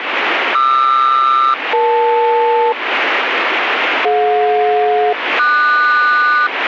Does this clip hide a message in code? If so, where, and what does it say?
Yes: aircraft SELCAL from 0.5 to 6.5 s, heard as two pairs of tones, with radio static. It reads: QR-EL DJ-QS